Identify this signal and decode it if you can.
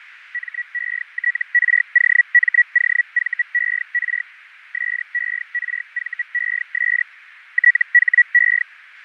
Hellschreiber (Feld-Hell, 122.5 baud), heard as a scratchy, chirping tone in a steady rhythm, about 1950 Hz, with radio static, fading and a narrow filter. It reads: METROMOVER SERVES THE